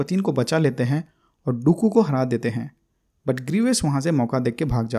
Speech in Hindi. There is no code.